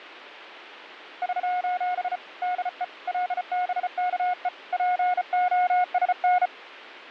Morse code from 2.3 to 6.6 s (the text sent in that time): DE LBKE POSN